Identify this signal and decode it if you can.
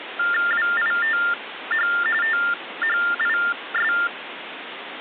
TTY/TDD text telephone tones (45.45 baud Baudot), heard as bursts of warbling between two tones, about 400 Hz shift, 1600 Hz centre, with phone line noise. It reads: WITH THIS